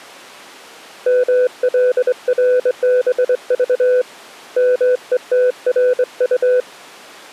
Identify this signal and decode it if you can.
Morse code, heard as a keyed tone, hand-sent with a straight key, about 23 wpm, 500 Hz. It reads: MLRBV METRU